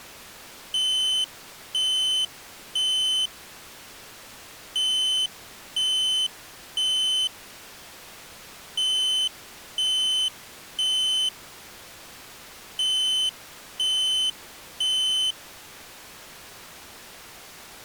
Alarm pattern, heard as an alarm's beeps, played four times, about 3050 Hz. Temporal three. Smoke or fire, evacuate.